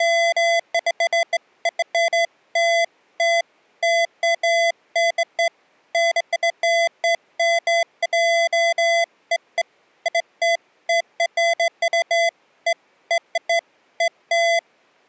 Beeps of irregular length. There is no code.